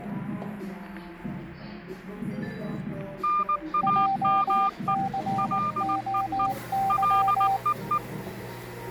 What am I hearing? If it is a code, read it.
Morse code, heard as two keyed tones, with the noise of a cafe. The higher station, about 19 wpm, 1200 Hz: NAME LEE LEE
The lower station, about 19 wpm, 780 Hz: JCOY